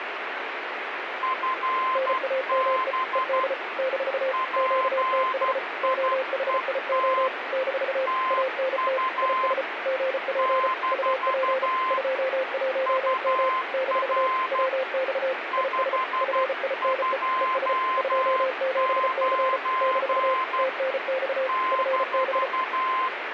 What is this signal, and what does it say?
Morse code, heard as two keyed tones, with radio static. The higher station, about 12 wpm, 1040 Hz: FB PIET TU - UR 529 -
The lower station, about 34 wpm, 520 Hz: NAME ED - QTH OHIO - ANT IS GP UP 21M - WX IS FINE ES 27C - TNX FB